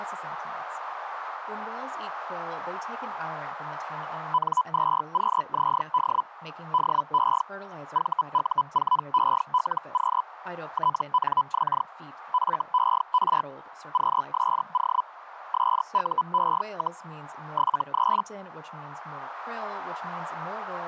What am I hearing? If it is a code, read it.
Hellschreiber (Feld-Hell, 122.5 baud), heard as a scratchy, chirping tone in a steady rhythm, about 1000 Hz, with radio static and speech in English. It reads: N2QZD DE VU4ELQ TNX FER QSO SUE, 73